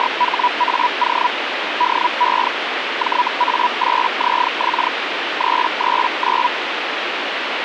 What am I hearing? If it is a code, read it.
Hellschreiber (Feld-Hell, 122.5 baud), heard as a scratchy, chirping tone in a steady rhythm, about 980 Hz, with radio static. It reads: … DE JA8ZX 339